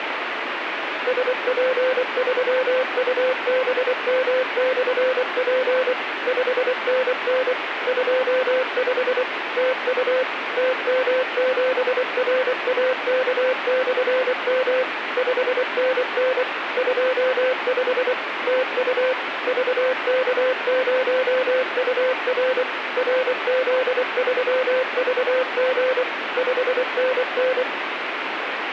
Morse code, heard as a keyed tone, machine-sent, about 24 wpm, 510 Hz, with radio static. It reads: SP3UBM/P 5NN 25 TU TM7RAK/M 5NN 25 TU VK0UR RZ3VG 5NN